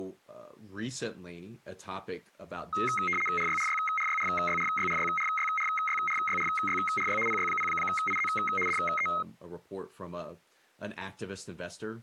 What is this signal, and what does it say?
RTTY (75 baud, 850 Hz shift), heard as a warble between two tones, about 1700 Hz centre, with speech in English. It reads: RYRYRYRYRYRYRYRYRYRYRY PY0IZ DE